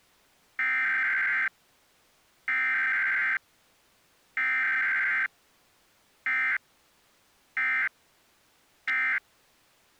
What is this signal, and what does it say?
Emergency Alert System (SAME) tones (header bursts, then end-of-message bursts), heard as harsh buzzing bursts, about 520.83 baud.